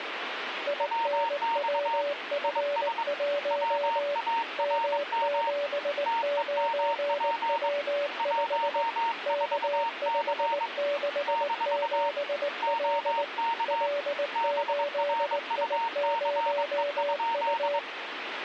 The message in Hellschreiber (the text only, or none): none